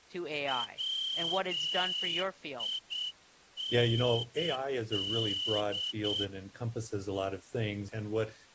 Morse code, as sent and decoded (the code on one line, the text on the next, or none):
.-- .. -. -..
WIND